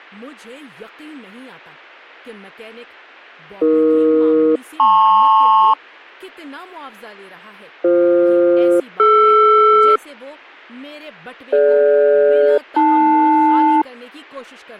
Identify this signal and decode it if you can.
Aircraft SELCAL, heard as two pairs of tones, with speech in Urdu. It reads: AE-LP BF-DR DG-AL